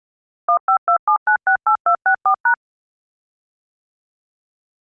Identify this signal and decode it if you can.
DTMF, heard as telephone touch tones, dialled by machine, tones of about 90 ms. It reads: 1527968264#